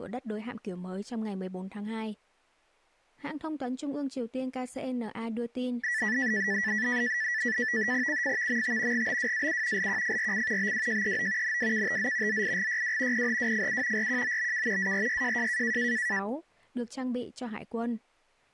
NAVTEX (SITOR-B), 100 baud, 170 Hz shift, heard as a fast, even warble, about 1850 Hz centre, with speech in Vietnamese. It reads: CFVMT GBWAU LQFRC BWJEO NWKTZ ZIGYW PHWFU RQOBK ARYJJ